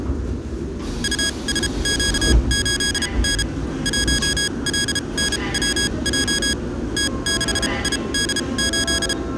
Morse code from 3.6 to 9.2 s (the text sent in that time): 1LNWJ T6ID8